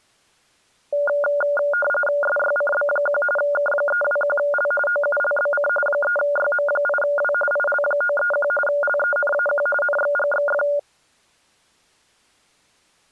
RTTY (45.45 baud, 850 Hz shift), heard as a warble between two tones, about 1000 Hz centre. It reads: SYCB1 K321L OULBC 3YM8W IL931 LENAQ NXGXF